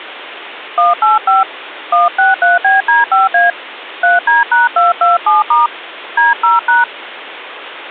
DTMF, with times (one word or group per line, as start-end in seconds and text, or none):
0.8-1.4 185
1.9-3.5 163BD5A
4.0-5.7 3D#227*
6.2-6.8 D0#